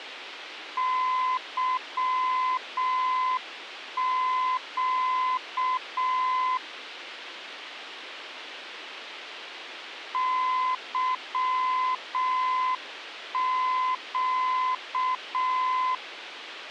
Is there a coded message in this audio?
Yes: Morse code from 0.7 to 16.0 s, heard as a keyed tone, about 6 wpm, 1020 Hz, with radio hiss. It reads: YQ YQ